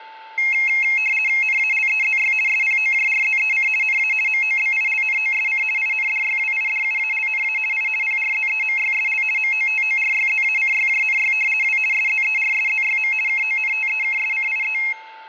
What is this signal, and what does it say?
RTTY (50 baud, 450 Hz shift), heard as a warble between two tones, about 2350 Hz centre, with a steady whistle near 880 Hz and room echo. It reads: NALEZY SPOJRZEC NA MOBILNOSC INDYWIDUALNA I PRZEMYSL MOTORYZACYJNY W SZERSZYM KONTEKSCIE